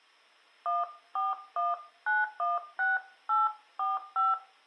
DTMF, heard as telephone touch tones, dialled by hand, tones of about 180 ms. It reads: 141916845